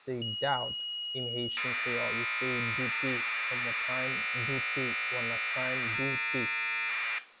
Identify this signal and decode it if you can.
Commodore tape loading (standard loader), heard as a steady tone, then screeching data, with room echo.